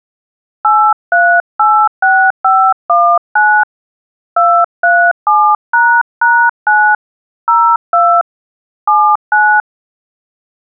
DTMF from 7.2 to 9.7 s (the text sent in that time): 02 79